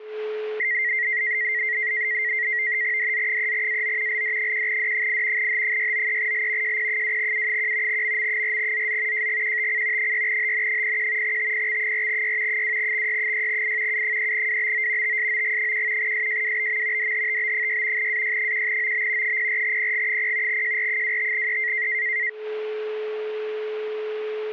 NAVTEX (SITOR-B), 100 baud, 170 Hz shift, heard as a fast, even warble, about 2000 Hz centre, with a steady whistle near 430 Hz. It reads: DZ3AO LD1D8 H693L JP2U1 MM4ZZ JGQTC 6HN01 TPX4Y 2XY6I U3WBO TSOG1 SJWBM DHTB6 AY1OB 04PG0 JR25E